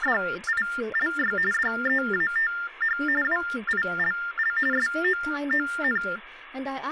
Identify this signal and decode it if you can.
TTY/TDD text telephone tones (45.45 baud Baudot), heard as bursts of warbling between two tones, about 400 Hz shift, 1600 Hz centre, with phone line noise and speech in English. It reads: … DEATH WILL SOON